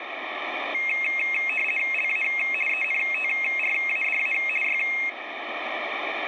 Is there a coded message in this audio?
Yes: RTTY (50 baud, 450 Hz shift) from 0.7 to 5.1 s, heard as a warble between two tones, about 2350 Hz centre, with radio static. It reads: LA ENTRADA Y